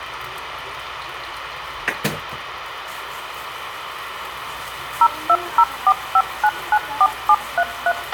DTMF, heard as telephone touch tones, dialled by machine, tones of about 60 ms, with radio hiss, a squelch burst at the end and kitchen noise. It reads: 02045994733